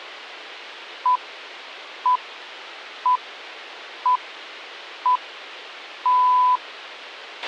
Radio time signal (six pips, as the Greenwich Time Signal), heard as pips, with a squelch burst at the end.